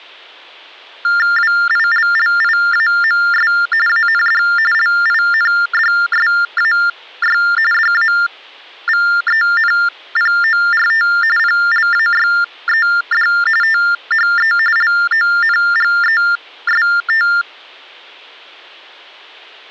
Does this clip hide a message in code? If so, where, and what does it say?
Yes: TTY/TDD text telephone tones (45.45 baud Baudot) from 1.0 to 17.4 s, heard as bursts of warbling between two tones, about 400 Hz shift, 1600 Hz centre. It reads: WILLIAMS AND LINDSAY DAVENPORT PLAYED THE LONGEST